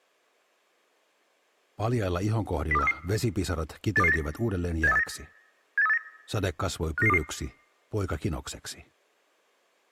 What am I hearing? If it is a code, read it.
Five-tone selective call (EEA), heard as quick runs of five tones, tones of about 40 ms. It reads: 02433 82289 78389 78389 59922